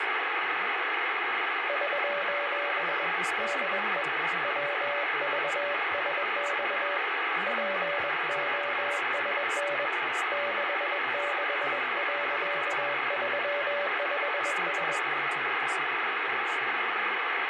Morse code, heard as a keyed tone, hand-sent with a bug key, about 21 wpm, 580 Hz, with radio static and speech in English. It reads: <SOS> DE WVSX POSN 66.35S